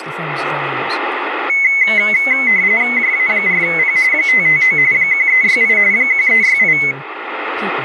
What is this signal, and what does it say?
RTTY (45.45 baud, 170 Hz shift), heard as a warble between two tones, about 2100 Hz centre, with radio static and speech in English. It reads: JA4P 559 1368 1368